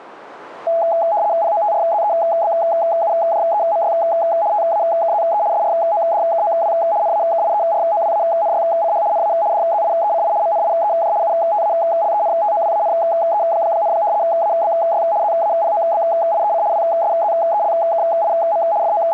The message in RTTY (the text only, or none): POTRZEBUJEMY TAKZE SRODKOW NAKIEROWANYCH NA DZIECI MNIEJ UTALENTOWANE, ABY ZAPOBIEC WSZELKIM …